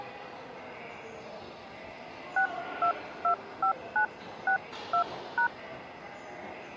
DTMF, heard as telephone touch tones, dialled by hand, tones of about 100 ms, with the noise of a subway station. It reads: 6225962#